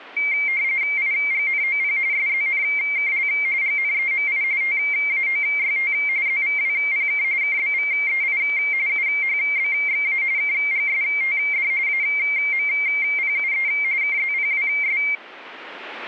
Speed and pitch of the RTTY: 45.45 baud, 170 Hz shift, 2200 Hz centre

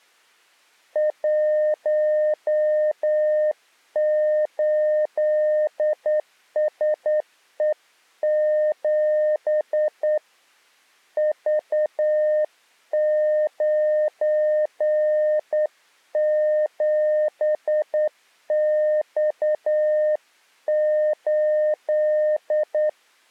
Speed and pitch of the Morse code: 9 wpm, 610 Hz

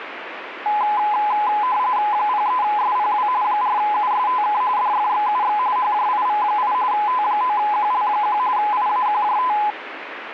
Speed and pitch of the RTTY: 45.45 baud, 170 Hz shift, 920 Hz centre

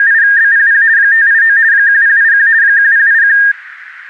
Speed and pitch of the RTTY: 50 baud, 170 Hz shift, 1700 Hz centre

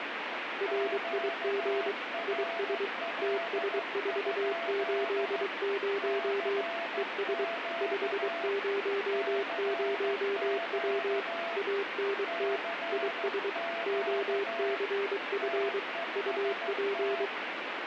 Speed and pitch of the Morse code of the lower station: 23 wpm, 400 Hz

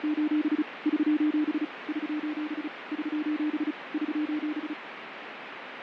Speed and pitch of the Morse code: 35 wpm, 300 Hz

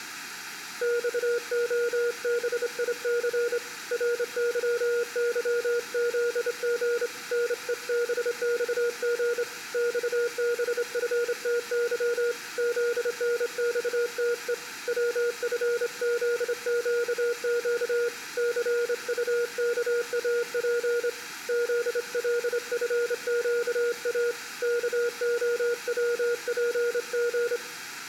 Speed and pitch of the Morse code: 27 wpm, 480 Hz

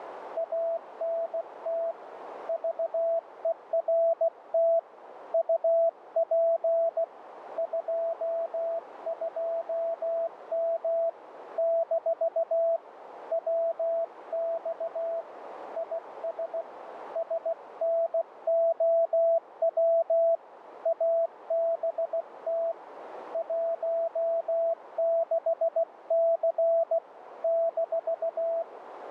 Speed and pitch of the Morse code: 16 wpm, 660 Hz

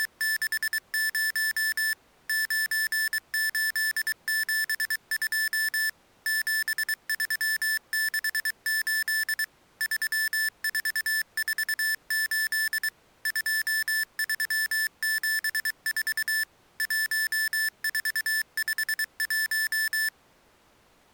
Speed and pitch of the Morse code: 23 wpm, 1750 Hz

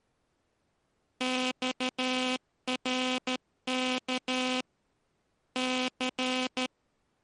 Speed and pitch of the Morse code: 13 wpm

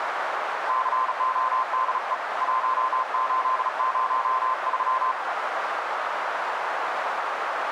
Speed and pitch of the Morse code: 36 wpm, 1040 Hz

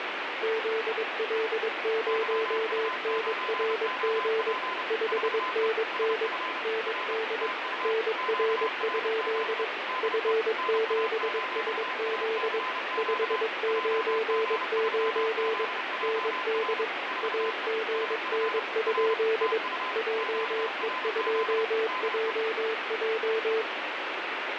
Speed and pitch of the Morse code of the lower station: 22 wpm, 440 Hz

